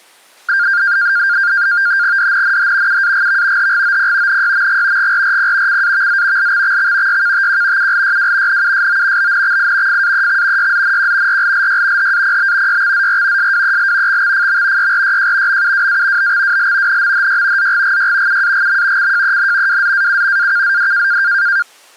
NAVTEX (SITOR-B), 100 baud, 170 Hz shift, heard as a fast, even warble, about 1500 Hz centre. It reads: DNNH UAGV HGOP NYMG GRRP CAVZ LXXX YKTQ ULYW NUSO BNXI FAEX YZNQ RLLY HAPB YXZR SWEL XXFM YRYJ MUWA BXWL NMHY ZGGY UAGM CJEN WZAU AKZD